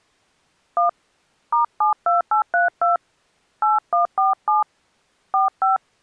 DTMF, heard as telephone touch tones, dialled by hand, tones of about 140 ms. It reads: 1 *72832 8147 45